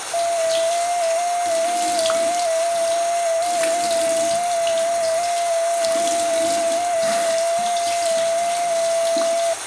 FT8 (one signal), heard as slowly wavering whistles, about 6.25 baud, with radio static, a narrow filter, room echo and the noise of a restroom.